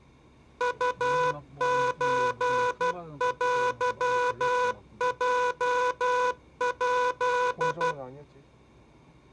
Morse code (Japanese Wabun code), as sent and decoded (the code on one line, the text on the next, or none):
..- ---. .-.-- .--- .--..
ウソテヲヱ